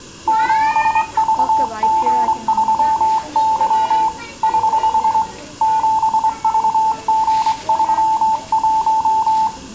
Morse code, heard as a keyed tone, hand-sent with a straight key, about 24 wpm, 880 Hz, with room echo and the noise of a crowd indoors. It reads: 7VG3Y <HH> 7VG31